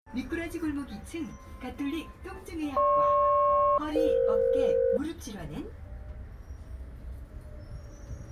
Aircraft SELCAL, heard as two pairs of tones, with the noise inside a bus. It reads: GP-EF